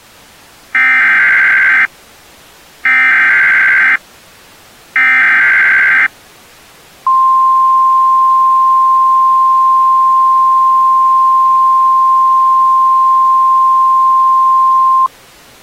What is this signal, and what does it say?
Emergency Alert System (SAME) tones (header bursts, then the 1050 Hz attention tone), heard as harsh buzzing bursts, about 520.83 baud.